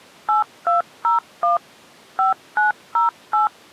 DTMF, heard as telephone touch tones, dialled by machine, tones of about 140 ms. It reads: 8201 5908